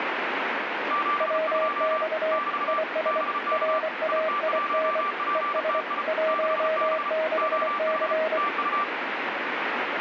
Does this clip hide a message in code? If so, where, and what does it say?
Yes: Morse code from 0.8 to 8.9 s, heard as two keyed tones, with radio static. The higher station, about 34 wpm, 1170 Hz: 72 <BT> BK IT1PTI 6B OH TU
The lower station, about 24 wpm, 630 Hz: WX IS RAIN ES 16C